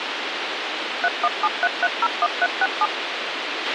DTMF, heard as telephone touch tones, dialled by machine, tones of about 40 ms, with radio hiss and a squelch burst at the end. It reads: 3173301367